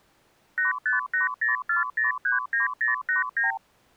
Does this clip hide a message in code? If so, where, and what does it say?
Yes: multi-frequency trunk signalling (R2, with the far end's replies) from 0.6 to 3.6 s, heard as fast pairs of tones, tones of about 140 ms. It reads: 85804039089